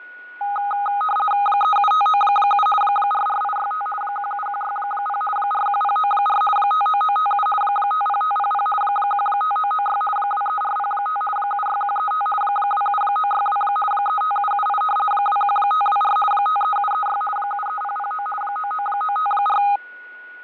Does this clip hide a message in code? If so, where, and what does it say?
Yes: RTTY (50 baud, 450 Hz shift) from 0.4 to 19.8 s, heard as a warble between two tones, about 1040 Hz centre, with fading and a steady whistle near 1460 Hz. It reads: 37597 44865 17160 41094 59957 50500 15996 23405 76135 27962 35778 21524 53736 73009 99954